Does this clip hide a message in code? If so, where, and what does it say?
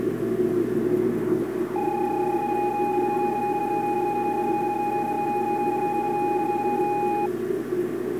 Yes: PSK31 (31.25 baud) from 1.8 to 7.3 s, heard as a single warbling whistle, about 830 Hz, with the noise inside a subway train.